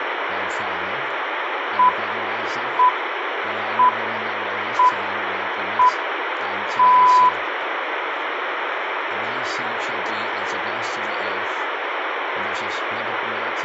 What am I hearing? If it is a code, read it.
Radio time signal (six pips, as the Greenwich Time Signal), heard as pips, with radio static and room echo.